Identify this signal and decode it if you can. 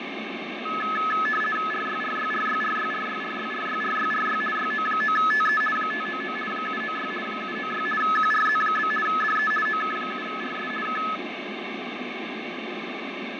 RTTY (50 baud, 450 Hz shift), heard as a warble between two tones, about 1500 Hz centre, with radio static and fading. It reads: RYRYRYRYRYRYRYRYRY YO9TE 599 796 796 QRZ? DE OK7RS K